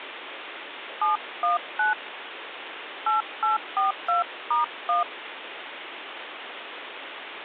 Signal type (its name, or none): DTMF